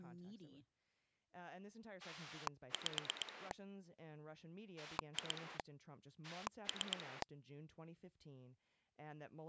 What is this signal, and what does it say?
Pulse dialling, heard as a rotary dial, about 8 pulses a second, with speech in English. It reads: 5 2 3